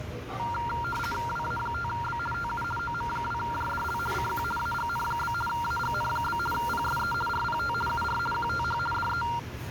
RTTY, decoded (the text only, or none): WA5B TU OM2JDL CQ AGN? AGN? PSE RPT UR QTH DE